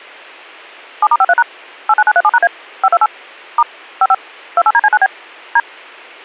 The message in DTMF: 7*53# 89937#A 528 * 55 28DC9B D

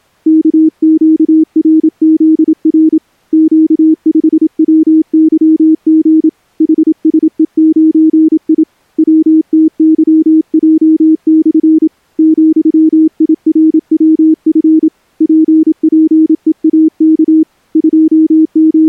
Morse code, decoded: KQRZR Q5WYG HSE9I WTYJ/ ,IRWF PPEAK …

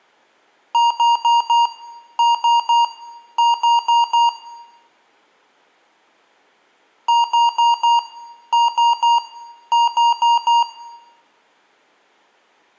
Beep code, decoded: 4-3-4

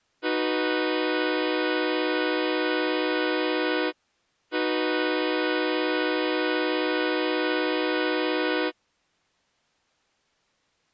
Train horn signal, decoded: 2 long

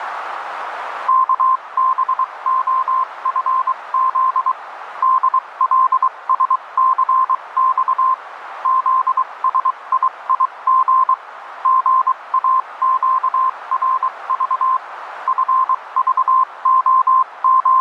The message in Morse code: KBOFZ DLSCX ZSIIG GAQRV …

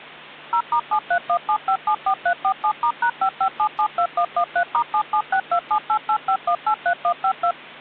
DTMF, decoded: 0*7317574347*#55772113*77627885183152

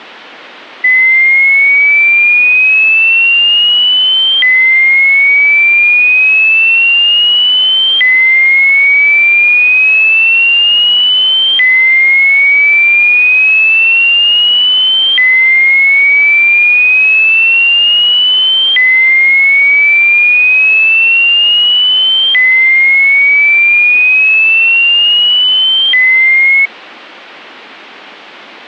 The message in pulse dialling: none

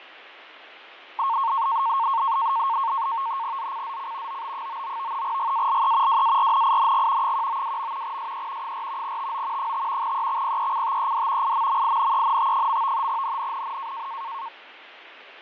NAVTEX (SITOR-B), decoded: ZCZC OB99 GALE WARNING 192. SE 4 TO 5 EXPECTED IMMINENT. NNNN

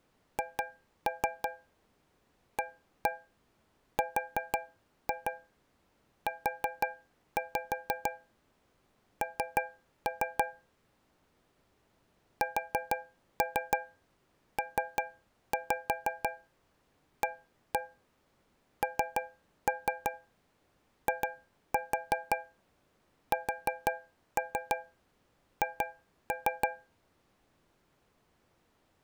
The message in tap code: HARUN SPANISH

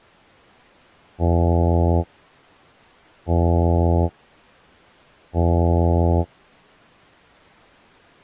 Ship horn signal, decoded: 3 short

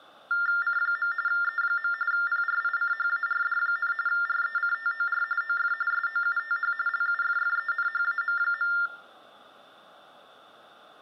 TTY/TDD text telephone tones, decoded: C. E. PRICHARD, RECTOR OF SOUTH LUFFENHAM.

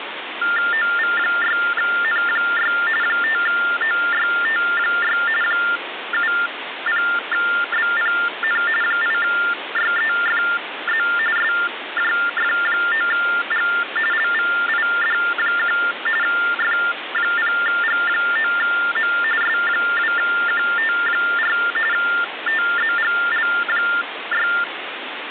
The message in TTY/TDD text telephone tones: OV6N6 5OYT6 70BPN 8YEFZ SJF9G LVID1 F0G9M S2QT4 TZGL6

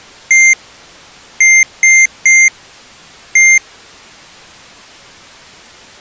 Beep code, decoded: 1-3-1

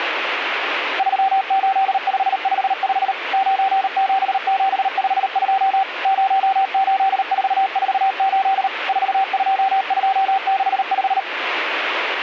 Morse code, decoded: 38555 97752 08448 42265

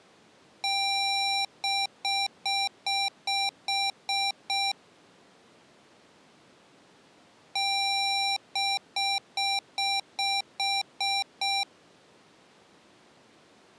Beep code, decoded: 1 long, 8 short

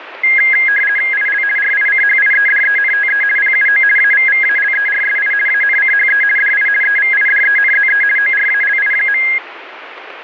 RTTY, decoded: IL RICHIEDENTE PUO AVVALERSI ANCHE DI EVIDENZE ORALI.

